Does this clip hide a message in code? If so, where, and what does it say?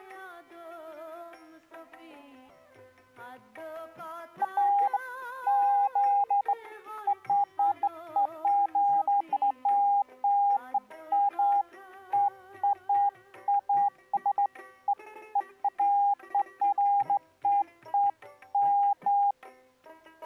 No, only beeps of irregular length.